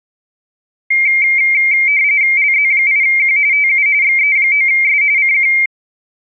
RTTY (45.45 baud, 170 Hz shift), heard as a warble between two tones, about 2200 Hz centre. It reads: LZ8Q TU XE9S CQ